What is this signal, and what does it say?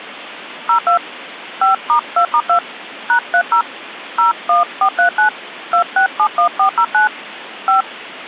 DTMF, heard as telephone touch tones, dialled by hand, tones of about 100 ms. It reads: 02 5*2*2 #30 01439 2671409 5